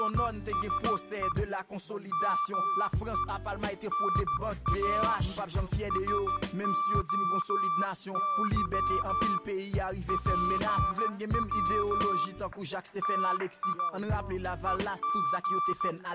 Morse code (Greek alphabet), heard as a keyed tone, hand-sent with a straight key, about 14 wpm, 1170 Hz. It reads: … ΜΕ ΝΑ ΣΟΥ ΠΩ ΤΙ …